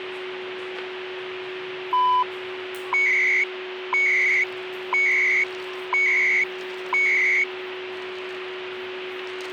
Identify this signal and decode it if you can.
Radio time signal (CHU, Canada), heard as beeps and data bursts, one a second, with radio static, a steady whistle near 370 Hz and the noise of a cafe.